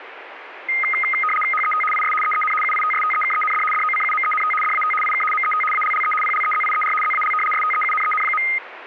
RTTY (75 baud, 850 Hz shift), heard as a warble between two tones, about 1700 Hz centre, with radio static. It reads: HET IS EEN UITSTEKEND DOCUMENT DAT IK MET ALLE PLEZIER ZAL STEUNEN.